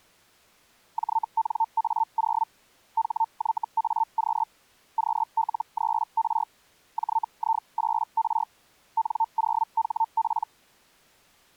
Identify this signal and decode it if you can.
Hellschreiber (Feld-Hell, 122.5 baud), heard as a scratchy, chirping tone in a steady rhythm, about 900 Hz. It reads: JNA0 HYAQ QL3R JI8R N0HP